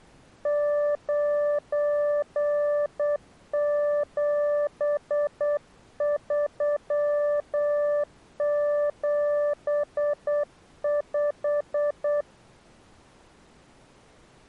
Morse code, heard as a keyed tone, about 8 wpm, 590 Hz. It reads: 97375